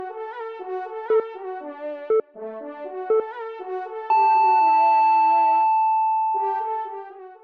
Radio time signal (three low pips and a long one an octave up, as on NHK), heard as pips.